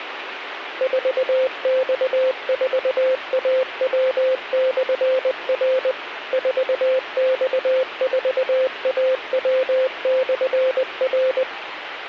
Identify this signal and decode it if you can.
Morse code, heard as a keyed tone, machine-sent, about 20 wpm, 520 Hz, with radio hiss. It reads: 4X4AW/R 4X4AW/R